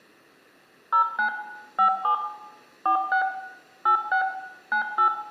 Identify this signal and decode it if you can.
DTMF, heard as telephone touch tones, dialled by machine, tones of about 100 ms, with room echo. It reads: 09 57 46 86 98